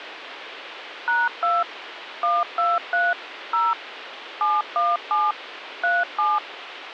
DTMF, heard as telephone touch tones, dialled by machine, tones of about 200 ms, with phone line noise. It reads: #2 123 0 717 37